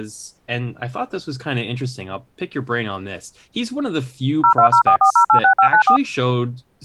DTMF, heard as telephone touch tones, dialled by machine, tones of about 90 ms, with speech in English. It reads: 02044086594